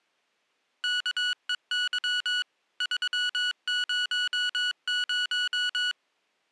Morse code, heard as electronic beeps, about 22 wpm, 1470 Hz. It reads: KEY 300